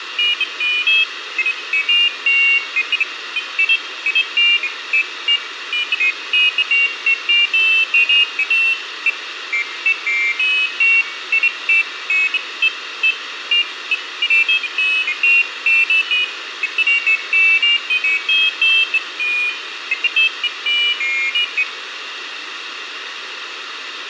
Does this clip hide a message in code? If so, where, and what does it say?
No, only pairs of high tones at irregular times, with radio hiss.